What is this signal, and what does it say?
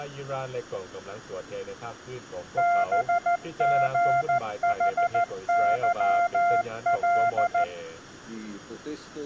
Morse code, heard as a keyed tone, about 14 wpm, 700 Hz, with room echo. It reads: BGHYL